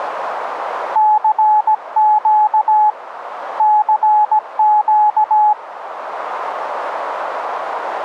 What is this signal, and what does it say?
Morse code, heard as a keyed tone, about 17 wpm, 850 Hz, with radio static. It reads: CQ CQ